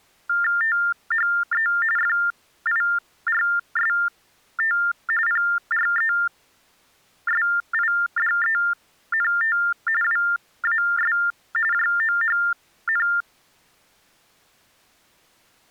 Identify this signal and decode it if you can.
TTY/TDD text telephone tones (45.45 baud Baudot), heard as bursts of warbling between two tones, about 400 Hz shift, 1600 Hz centre. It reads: THE FIRST PRESIDENT WAS JOHN